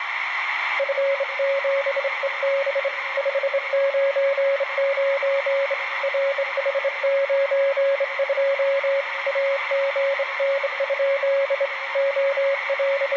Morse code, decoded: F7EB 599 RH92 AGN? …

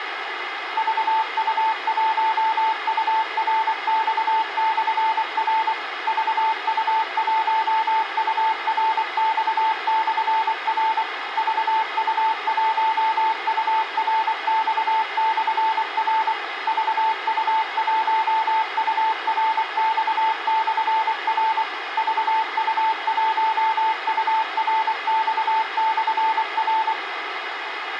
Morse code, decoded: VU1URX/R VU1URX/R VU1URX/R VU1URX/R VU1URX/R

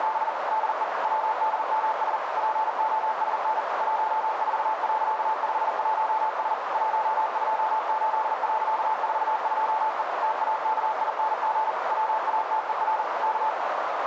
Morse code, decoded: … DE WDMS POSN 14.51S 128.42E TAKING WATER K

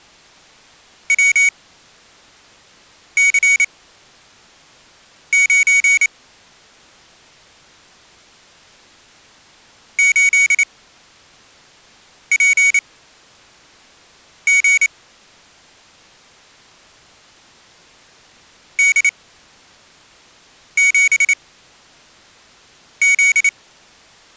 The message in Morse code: WC9 8PG D7Z

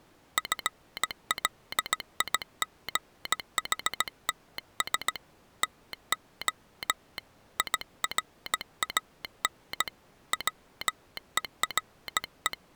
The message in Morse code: FLIGHTS TO IRAN WERE

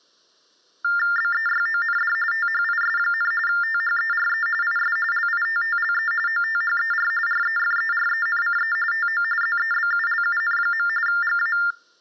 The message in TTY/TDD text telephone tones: BEYOND THIS, THERE IS LITTLE OTHER REFERENCE TO ZEBULUN. GA

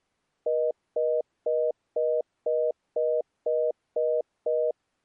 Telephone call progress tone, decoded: congestion tone

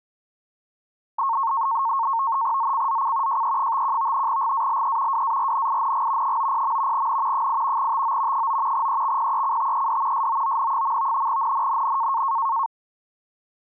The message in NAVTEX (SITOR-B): ZCZC JE51 GALE WARNING 90. N 8 TO 9 EXPECTED SOON. NNNN

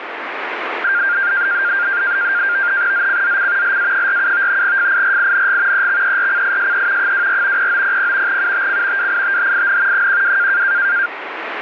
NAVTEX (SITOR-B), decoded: ZCZC LA47 FIRING EXERCISE 24 0900 UTC WITHIN 12

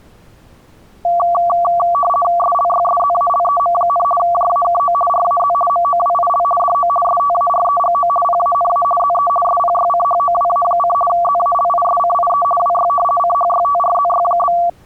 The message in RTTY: SLYSZALEM, JAKO RAZ MOWIL DO STAREGO PANA ZE SPYCHOWA: ZALISCIE WY CHYTRZY?

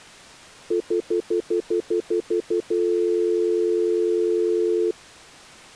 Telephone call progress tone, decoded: stutter dial tone

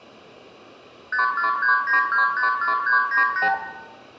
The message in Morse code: none

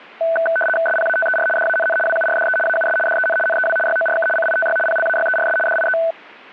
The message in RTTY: SPATER DANN WURDE AUS DEN NEW YORK CITY PLAYERS DIE

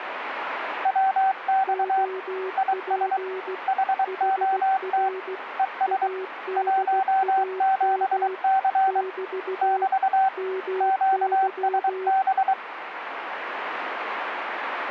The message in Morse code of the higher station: WX IS HOT ES 17C <BT> QSB

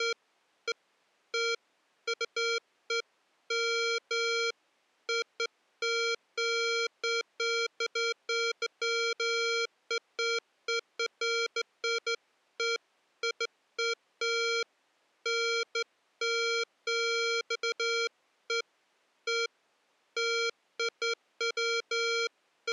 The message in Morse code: none

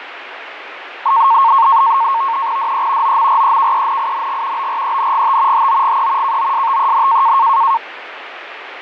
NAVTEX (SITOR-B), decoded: DE OMREKENING BRENGT HOGE KOSTEN

